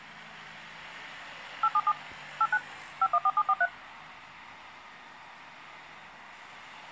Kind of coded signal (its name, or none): DTMF